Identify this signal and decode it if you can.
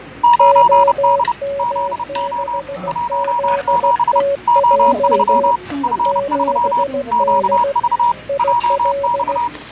Morse code, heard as two keyed tones, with fading, static crashes and the noise of a restaurant. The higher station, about 30 wpm, 960 Hz: 9D ZO 17 O3 F3 QV JX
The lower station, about 16 wpm, 560 Hz: OM6ZTJ 7D IL